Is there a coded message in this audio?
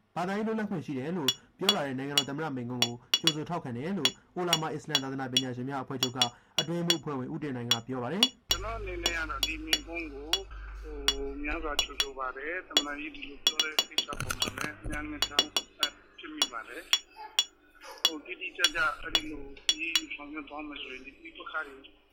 No, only irregular taps on glass.